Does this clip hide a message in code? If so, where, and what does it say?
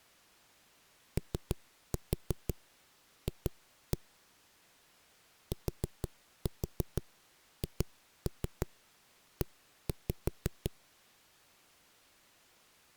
Yes: tap code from 1.2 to 10.7 s, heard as knocks on a wall, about 6 knocks a second. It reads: OF THE